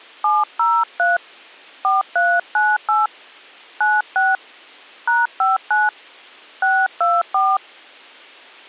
DTMF, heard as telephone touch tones, dialled by hand, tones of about 200 ms. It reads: 703 4398 96 #59 624